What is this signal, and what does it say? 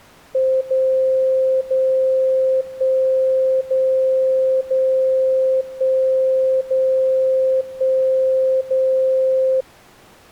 Radio time signal (DCF77), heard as a tone whose level steps once a second, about 520 Hz. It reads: 0 0 1 0 0 1 0 1 0